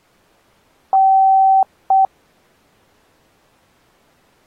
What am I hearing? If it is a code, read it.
Beep code, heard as beeps, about 770 Hz. 1 long, 1 short. In IBM BIOS tables: system board problem.